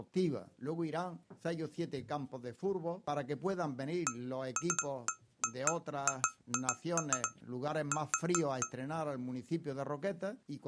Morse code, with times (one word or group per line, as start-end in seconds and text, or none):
none